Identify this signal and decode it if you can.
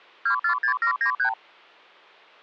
Multi-frequency trunk signalling (R2, with the far end's replies), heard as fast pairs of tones, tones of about 90 ms. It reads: 246793